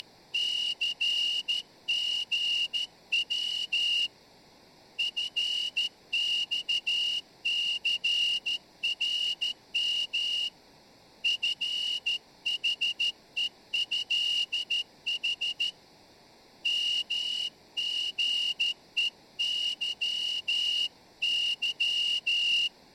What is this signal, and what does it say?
Morse code (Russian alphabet), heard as a whistle, hand-sent with a straight key, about 13 wpm, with room echo. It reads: … ФЬЦРМ ФХЕЭХ МГЕЫЫ